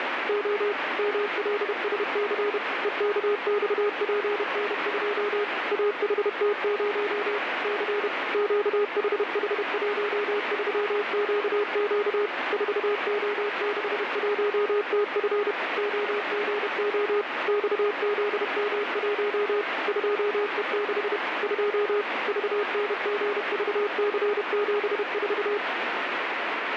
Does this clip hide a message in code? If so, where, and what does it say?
Yes: Morse code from 0.2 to 25.6 s, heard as a keyed tone, machine-sent, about 31 wpm, 410 Hz, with radio static. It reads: O MLSC EKXPN2 AHT0 C QHH13QQ 4O61TF OGO XZM1 2E6 2 VNGVC74